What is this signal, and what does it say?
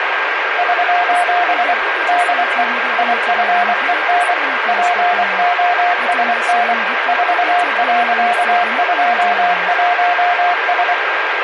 Morse code, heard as a keyed tone, machine-sent, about 24 wpm, 710 Hz, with radio static and a steady whistle near 1600 Hz. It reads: <SOS> DE IFEN POSN 4.21S